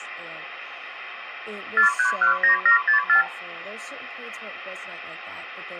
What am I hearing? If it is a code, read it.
Multi-frequency trunk signalling (R2, with the far end's replies), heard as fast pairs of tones, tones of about 110 ms, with phone line noise and speech in English. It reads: 4319764